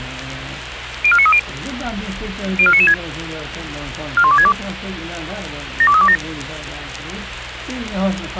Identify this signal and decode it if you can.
Five-tone selective call (ZVEI), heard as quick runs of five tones, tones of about 70 ms, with radio hiss and a squelch burst at the end. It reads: 04930 04996 41262 72327